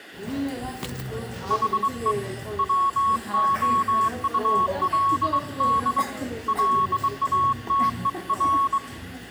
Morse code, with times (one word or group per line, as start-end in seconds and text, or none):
1.5-2.1 HE
2.6-6.0 WOULD
6.5-8.8 LATER